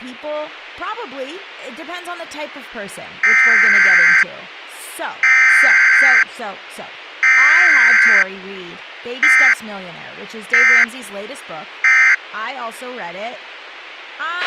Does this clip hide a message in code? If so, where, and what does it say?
Yes: Emergency Alert System (SAME) tones (header bursts, then end-of-message bursts) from 3.2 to 12.1 s, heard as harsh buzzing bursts, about 520.83 baud, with a squelch burst at the end and speech in English.